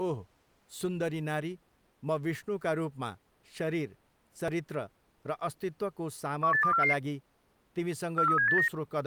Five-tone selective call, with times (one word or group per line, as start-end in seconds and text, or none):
6.4-6.9 18244
8.2-8.7 43789